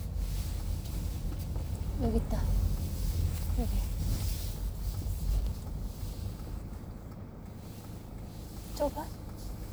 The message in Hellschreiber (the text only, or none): none